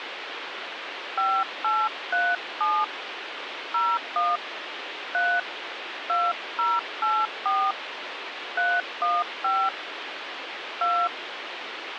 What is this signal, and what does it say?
DTMF, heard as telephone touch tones, dialled by hand, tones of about 240 ms, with phone line noise. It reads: 5837 01 3 2084 315 2